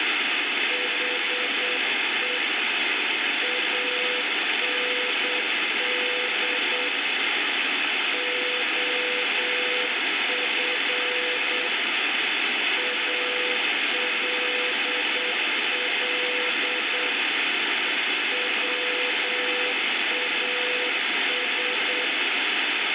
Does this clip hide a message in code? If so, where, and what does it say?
Yes: Morse code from 0.6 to 22.1 s, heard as a keyed tone, hand-sent with a paddle, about 8 wpm, 500 Hz, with heavy radio static. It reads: HE AND OF ALL WAS